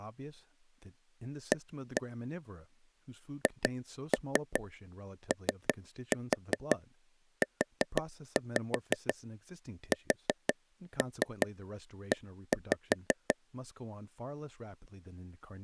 Tap code, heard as taps on a table, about 5 knocks a second, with speech in English. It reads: A HOUSE